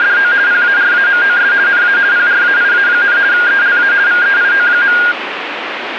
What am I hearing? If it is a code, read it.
RTTY (50 baud, 170 Hz shift), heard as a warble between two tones, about 1500 Hz centre, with radio static. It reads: … PARAMOS NA PRAIA, ELA VEIO.